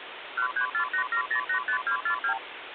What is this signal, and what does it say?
Multi-frequency trunk signalling (R2, with the far end's replies), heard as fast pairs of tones, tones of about 90 ms, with phone line noise. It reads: 13487085242